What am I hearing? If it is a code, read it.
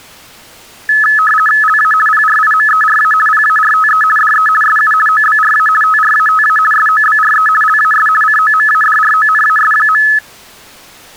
RTTY (50 baud, 450 Hz shift), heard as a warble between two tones, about 1500 Hz centre. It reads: LA PRIMERA PARTE DE SU OBRA TRATA SOBRE LAS COMADRONAS.